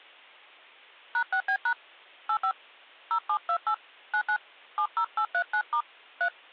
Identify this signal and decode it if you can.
DTMF, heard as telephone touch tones, dialled by hand, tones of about 80 ms. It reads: #6B# 85 0728 99 70839* 3